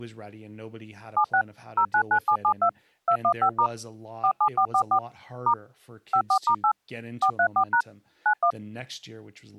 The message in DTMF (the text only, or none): 76 099772 215* 47444 * 54*8 434# 91